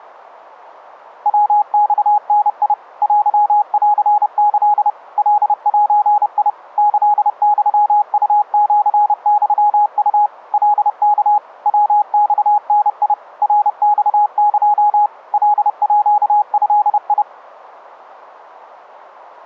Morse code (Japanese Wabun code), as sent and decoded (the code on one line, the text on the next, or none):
.-- -..- -. .. / .-.-- .-.-. -.-.. / .-.. .---. .. / -.-.. -..-- ..- --.-. -..-- ..- / .-.. -.- / .-- -..- -. .. / .-. -..- -.--- / .-.. .--.- ..-.. ..
ヤマダ テンキ カゼ キユウシユウ カワ ヤマダ ナマエ カード